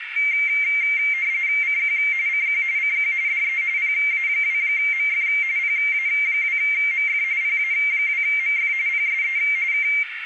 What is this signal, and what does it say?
RTTY (45.45 baud, 170 Hz shift), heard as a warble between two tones, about 2200 Hz centre, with radio static and a narrow filter. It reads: CQ CQ CQ DE PA2MF PA2MF PA2MF PSE K